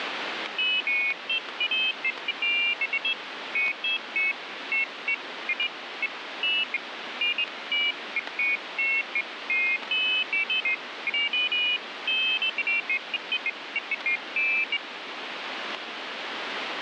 Pairs of high tones at irregular times, with radio static. There is no code.